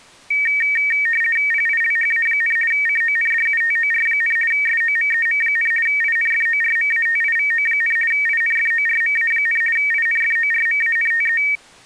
RTTY (50 baud, 450 Hz shift), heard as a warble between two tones, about 2050 Hz centre. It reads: PILHA, CONDUTOR, SOMEM, INFORMATIVO, INFORMA, INFORMANTE